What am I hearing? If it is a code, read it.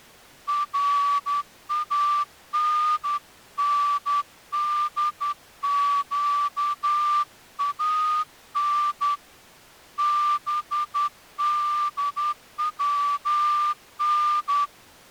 Morse code (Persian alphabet), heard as a whistle, hand-sent with a straight key, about 11 wpm. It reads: رانندگان بدون